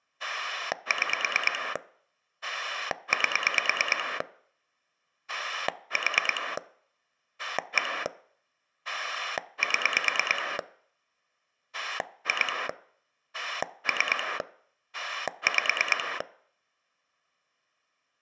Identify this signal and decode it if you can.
Pulse dialling, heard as a rotary dial, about 9 pulses a second. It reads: 6 8 4 1 7 2 3 5